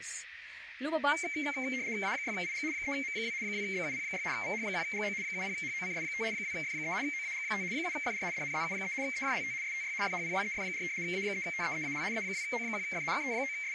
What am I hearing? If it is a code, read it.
RTTY (75 baud, 170 Hz shift), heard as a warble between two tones, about 2200 Hz centre, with radio static, a narrow filter and speech in Filipino. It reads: A6IG 3M2 2BUP6 VH1GO 70HOCS5 2F3 OAG5 7FR DNZU3 EJLT STY FHPYEF4 A3TEEAL A2O1F …